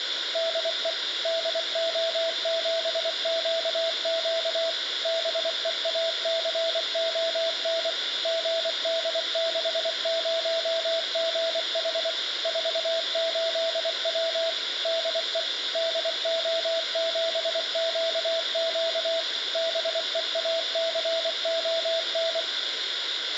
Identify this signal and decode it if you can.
Morse code, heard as a keyed tone, machine-sent, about 24 wpm, 660 Hz, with radio hiss, a squelch burst at the end and room echo. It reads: DE DO7QQ BEACON GD60GH 48W DE DO7QQ BEACON